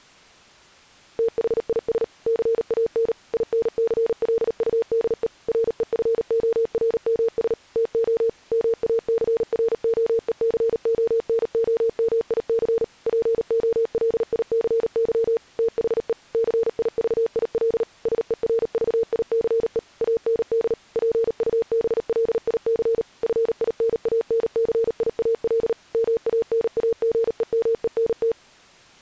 Morse code, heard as a keyed tone, machine-sent, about 38 wpm, 460 Hz. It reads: THIS CAN INCLUDE REFORMS TO MACROECONOMIC POLICY THE CIVIL SERVICE AND PUBLIC FINANCIAL MANAGEMENT